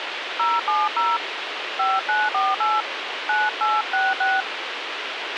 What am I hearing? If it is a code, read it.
DTMF, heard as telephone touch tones, dialled by hand, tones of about 200 ms, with radio hiss and a squelch burst at the end. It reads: 070 5948 9866